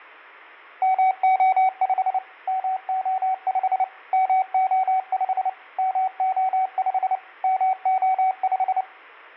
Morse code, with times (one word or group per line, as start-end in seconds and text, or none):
0.8-2.2 MO5
2.5-3.8 MO5
4.1-5.5 MO5
5.8-7.2 MO5
7.4-8.8 MO5